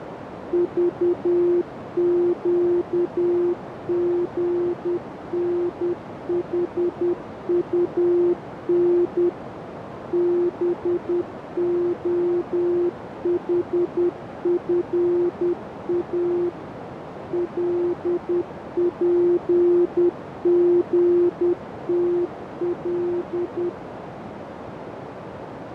Morse code, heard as a keyed tone, machine-sent, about 10 wpm, 350 Hz, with radio static and a narrow filter. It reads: VQGNHUN BOHFA LPGTL